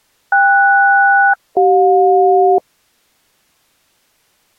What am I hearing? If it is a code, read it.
Aircraft SELCAL, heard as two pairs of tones. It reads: KS-CJ